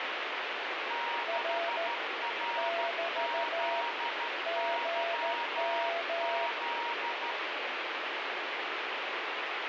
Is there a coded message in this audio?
Yes: Morse code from 0.8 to 7.4 s, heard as two keyed tones, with heavy radio static. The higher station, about 13 wpm, 940 Hz: 6RZYZ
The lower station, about 14 wpm, 680 Hz: R <BT> GM